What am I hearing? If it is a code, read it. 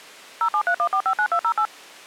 DTMF, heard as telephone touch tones, dialled by machine, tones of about 80 ms. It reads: 0731459208